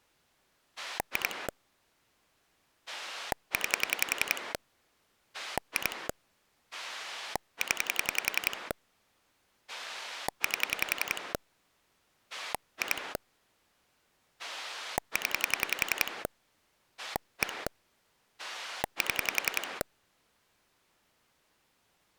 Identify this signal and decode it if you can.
Pulse dialling, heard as a rotary dial, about 10 pulses a second. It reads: 2 9 2 0 8 2 0 1 7